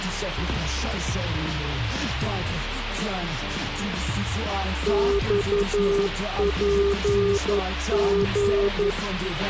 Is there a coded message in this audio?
Yes: Morse code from 4.8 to 9.0 s, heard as a keyed tone, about 11 wpm, 400 Hz, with radio hiss and a squelch burst at the end. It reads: XPG